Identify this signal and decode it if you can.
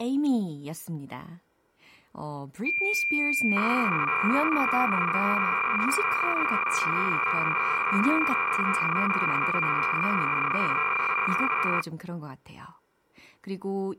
Cassette data (Kansas City type), 300 baud, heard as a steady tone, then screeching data, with speech in Korean.